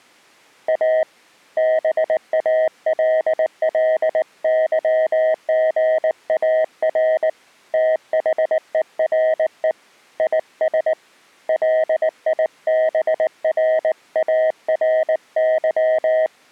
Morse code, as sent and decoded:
.- / -... .- .-.. .-.. -.-- --. .- .-. / - .... . .-. . / .. ... / .-.. .. -... .-. .- .-. -.--
A BALLYGAR THERE IS LIBRARY

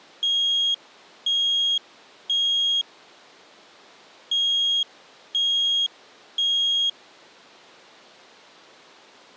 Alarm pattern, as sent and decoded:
3 beeps and a pause
temporal three

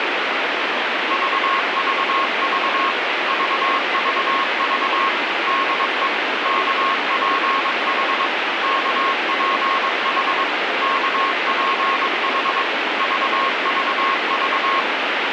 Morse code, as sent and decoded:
...- ...- ...- / ...- ...- ...- / -.. . / -.- .--. .... / -.- .--. .... / -.- .--. .... / ...- ...- ...-
VVV VVV DE KPH KPH KPH VVV

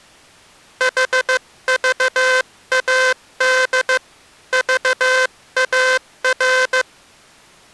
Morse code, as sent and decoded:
.... ...- .- -.. / ...- .- .-.
HVAD VAR

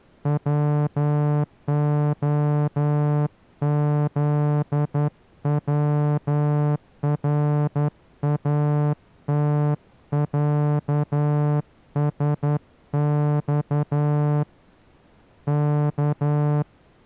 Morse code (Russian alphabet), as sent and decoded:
.-- --- --.. .-- .-. .- - .-.- ... -..- / -.-
ВОЗВРАТЯСЬ К

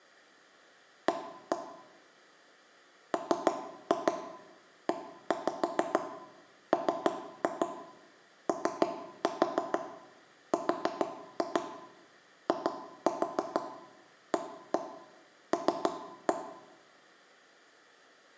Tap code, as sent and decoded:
1-1 / 3-2 1-5 3-2 3-4 4-2 2-4 1-1 3-1
A MEMORIAL

